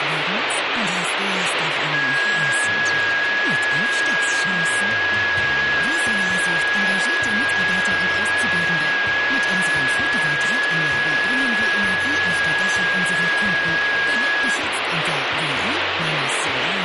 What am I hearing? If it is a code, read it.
FT8 (one signal), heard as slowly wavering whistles, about 6.25 baud, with radio static.